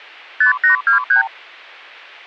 Multi-frequency trunk signalling (R2, with the far end's replies), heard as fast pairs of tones, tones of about 120 ms. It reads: 5823